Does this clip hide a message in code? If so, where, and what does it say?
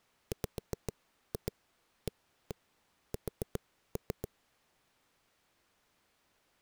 Yes: tap code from 0.3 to 4.3 s, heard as knocks on a wall, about 7 knocks a second. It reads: WAS